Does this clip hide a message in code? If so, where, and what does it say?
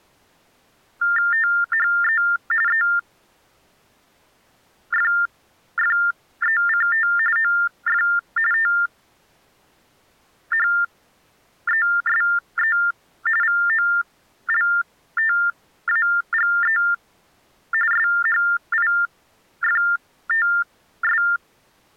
Yes: TTY/TDD text telephone tones (45.45 baud Baudot) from 1.0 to 21.4 s, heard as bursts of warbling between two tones, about 400 Hz shift, 1600 Hz centre. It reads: THE EFFECT OF THESE VOLTAGE SHIFTS